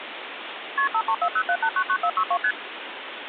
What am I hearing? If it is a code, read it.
Multi-frequency trunk signalling (R1, as on North American trunks), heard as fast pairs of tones, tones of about 70 ms, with phone line noise. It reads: KP 53407899462 ST